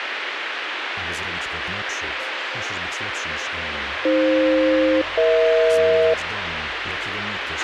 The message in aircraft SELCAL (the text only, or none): AF-EH